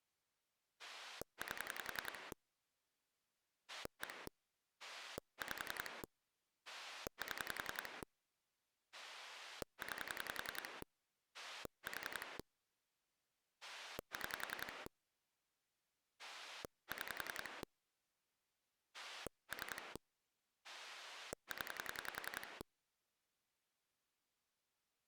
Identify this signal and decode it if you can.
Pulse dialling, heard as a rotary dial, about 10 pulses a second. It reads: 8 1 5 7 9 4 6 6 3 0